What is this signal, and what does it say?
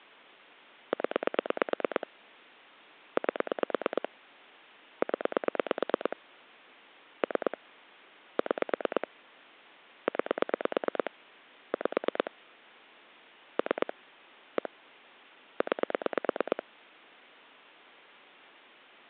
Pulse dialling, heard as clicks on a phone line, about 9 pulses a second. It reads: 0 8 0 3 6 9 5 3 1 9